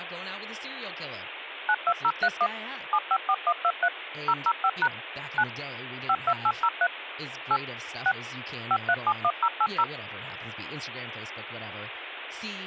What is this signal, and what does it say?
DTMF, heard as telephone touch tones, dialled by machine, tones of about 60 ms, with phone line noise and speech in English. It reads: 92031 754123 005# 9 52803 8 6 5371080